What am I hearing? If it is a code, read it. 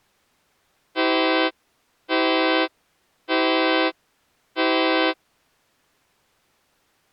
Train horn signal, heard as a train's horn. 4 short. On North American railways: a request for a signal to be given or repeated.